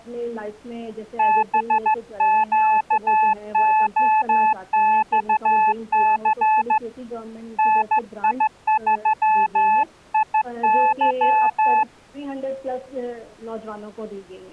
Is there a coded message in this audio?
Yes: Morse code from 1.1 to 11.9 s, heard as a keyed tone, hand-sent with a straight key, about 14 wpm, 870 Hz. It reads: BQOXC NI3IY